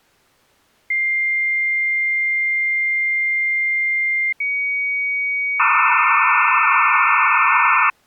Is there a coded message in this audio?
Yes: dial-up modem handshake (low-speed, two carriers) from 0.9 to 7.9 s, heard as two whistles, then hiss.